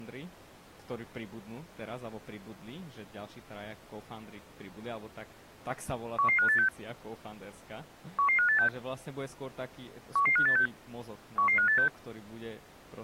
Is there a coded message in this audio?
Yes: five-tone selective call (CCIR) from 6.2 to 11.9 s, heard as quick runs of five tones, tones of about 100 ms, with speech in Slovak. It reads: 11586 11586 11586 11586